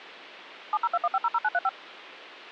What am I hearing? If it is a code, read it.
DTMF, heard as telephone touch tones, dialled by machine, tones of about 40 ms. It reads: 7021500935